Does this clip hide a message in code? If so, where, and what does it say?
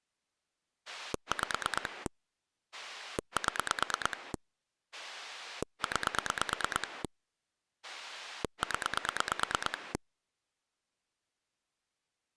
Yes: pulse dialling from 0.9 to 10.0 s, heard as a rotary dial, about 9 pulses a second. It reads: 5 7 9 0